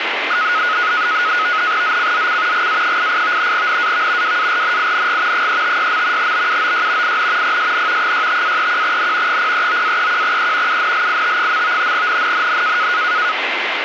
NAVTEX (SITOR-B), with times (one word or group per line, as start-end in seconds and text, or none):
1.8-2.7 ZCZC
2.5-3.5 GA88
3.5-4.4 NAV
4.2-5.5 WARNING
5.3-6.3 356.
6.2-7.2 BUOY
7.0-7.6 IN
7.4-8.1 PSN
8.0-9.4 65-31N
9.3-10.8 039-31E
10.7-11.9 UNLIT.
11.9-12.9 NNNN